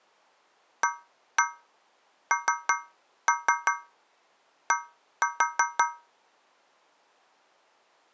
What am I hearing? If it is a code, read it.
Tap code, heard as taps on a metal pipe, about 5 knocks a second. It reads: AND